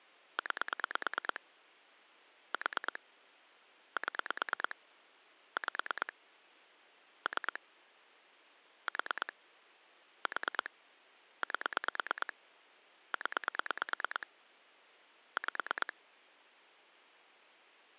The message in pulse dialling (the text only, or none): 9 4 7 5 3 4 4 8 0 5